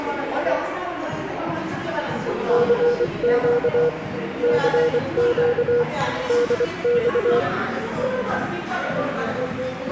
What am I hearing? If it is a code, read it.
Morse code, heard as a keyed tone, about 24 wpm, 480 Hz, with the noise of a crowd indoors. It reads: CQ CQ DX